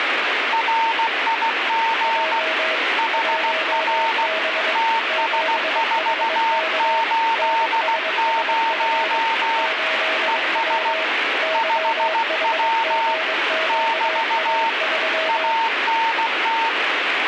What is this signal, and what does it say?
Morse code, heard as two keyed tones, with radio static. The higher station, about 16 wpm, 910 Hz: RIG HR TS480 ES 5W <BT> ANT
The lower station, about 22 wpm, 640 Hz: J 1B 7HK NSSF 8W YHGQA3